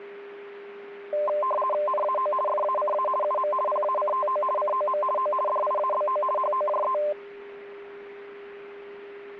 RTTY (50 baud, 450 Hz shift), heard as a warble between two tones, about 820 Hz centre, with a steady whistle near 400 Hz. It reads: NAO FACA UM PACTO COM O DIABO HOJE